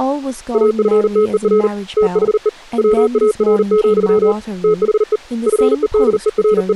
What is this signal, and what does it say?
Morse code, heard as a keyed tone, hand-sent with a paddle, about 39 wpm, 430 Hz, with speech in English. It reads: AFTER THE WAR, THE …